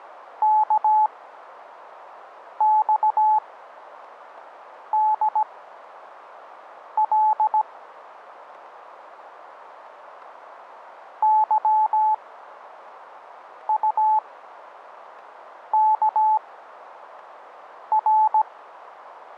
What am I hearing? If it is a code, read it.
Morse code, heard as a keyed tone, machine-sent, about 17 wpm, spaced as for 5 wpm, 860 Hz, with radio static. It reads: KXDL YUKR